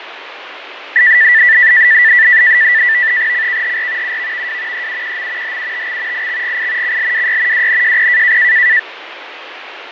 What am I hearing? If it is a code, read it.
NAVTEX (SITOR-B), 100 baud, 170 Hz shift, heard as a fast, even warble, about 1850 Hz centre, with radio static and fading. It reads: CKHR UVVW EUQM HUTX IXGI CLWY WNJP